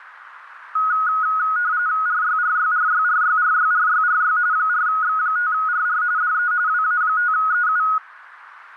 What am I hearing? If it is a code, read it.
RTTY (45.45 baud, 170 Hz shift), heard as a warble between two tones, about 1360 Hz centre, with radio static. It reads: RYRYRYRYRYRYRY 4X5RR DE WA5EU